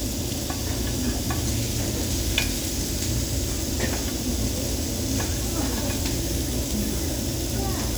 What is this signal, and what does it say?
The noise of a restaurant. There is no code.